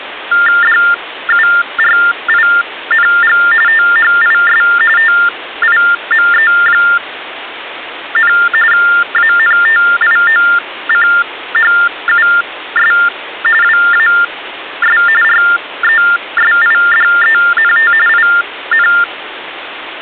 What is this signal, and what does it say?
TTY/TDD text telephone tones (45.45 baud Baudot), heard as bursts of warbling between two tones, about 400 Hz shift, 1600 Hz centre, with phone line noise. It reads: DURING THIS TIME, ANTIOCHUS WAS RESIDENT IN